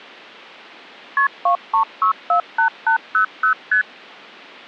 Multi-frequency trunk signalling (R1, as on North American trunks), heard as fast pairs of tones, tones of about 100 ms. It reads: KP 23648800 ST